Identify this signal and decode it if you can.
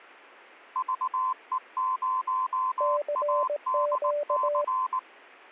Morse code, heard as two keyed tones. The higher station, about 19 wpm, 1030 Hz: VE0ADC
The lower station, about 18 wpm, 590 Hz: CQ